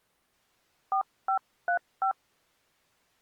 DTMF, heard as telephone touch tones, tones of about 100 ms. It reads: 4535